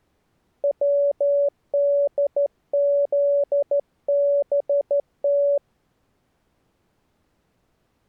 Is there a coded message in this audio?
Yes: Morse code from 0.6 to 5.6 s, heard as a keyed tone, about 13 wpm, 570 Hz. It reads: WDZBT